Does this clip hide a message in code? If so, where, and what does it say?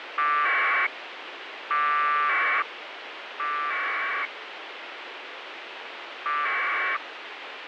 Yes: packet radio (AX.25, as in APRS), 1200 baud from 0.2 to 7.0 s, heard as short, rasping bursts, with radio hiss.